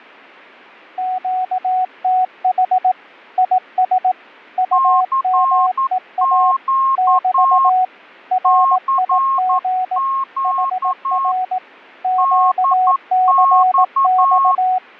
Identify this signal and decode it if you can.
Morse code, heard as two keyed tones, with fading. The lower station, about 18 wpm, 740 Hz: QTH IS UMEA <BT> RIG HR QCX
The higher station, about 11 wpm, 1080 Hz: CQ CQ DX